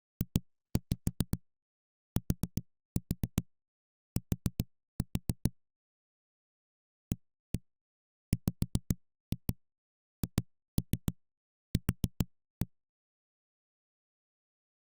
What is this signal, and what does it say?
Tap code, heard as knocks on a wall, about 7 knocks a second. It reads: JTT AWHQ